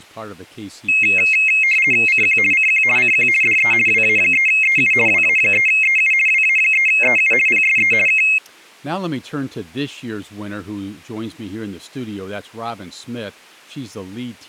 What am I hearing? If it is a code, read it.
RTTY (50 baud, 450 Hz shift), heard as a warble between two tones, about 2350 Hz centre, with speech in English. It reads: CQ CQ CQ DE WA3EU WA3EU WA3EU PSE K